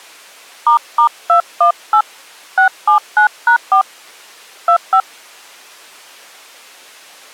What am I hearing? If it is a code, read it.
DTMF, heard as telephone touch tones, dialled by hand, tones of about 90 ms. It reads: **218 679#4 25